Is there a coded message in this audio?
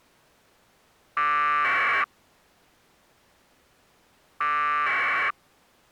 Yes: packet radio (AX.25, as in APRS), 1200 baud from 1.2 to 5.3 s, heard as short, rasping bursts.